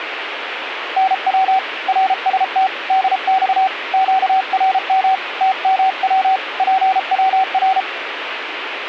Morse code, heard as a keyed tone, hand-sent with a paddle, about 33 wpm, 760 Hz, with radio static. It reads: NW RST DX QRM TMW PWR